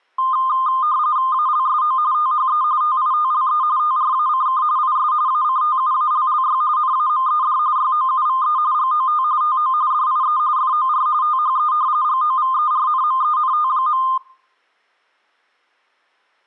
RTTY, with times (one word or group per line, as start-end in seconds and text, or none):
1.3-2.0 ALSO
2.1-2.6 THE
2.8-3.6 TITLE
3.8-4.6 TRACK
4.8-5.1 IS
5.3-6.6 ACTUALLY
6.8-7.6 NAMED
7.8-8.6 YOUVE
8.7-9.2 GOT
9.4-9.7 TO
9.9-10.4 DIE
10.6-11.1 FOR
11.2-11.7 THE
12.0-14.0 GOVERNMENT.